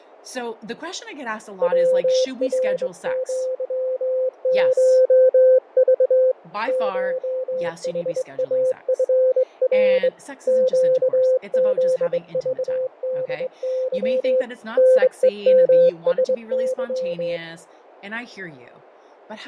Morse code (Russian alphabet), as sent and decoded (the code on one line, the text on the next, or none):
.-- .-. --.-- ---- ...- / ---- .... .- ..-. .-. / --.- --.. ...- -.. -.-- / -. . -- ... -.--
ВРЪШЖ ШХАФР ЩЗЖДЫ НЕМСЫ